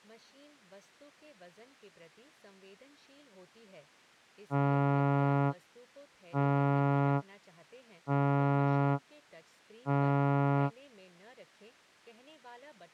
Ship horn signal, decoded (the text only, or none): 4 short